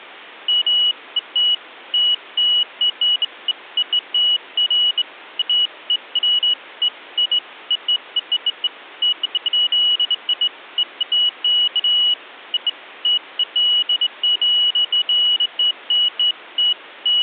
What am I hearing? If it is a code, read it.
Beeps of irregular length. There is no code.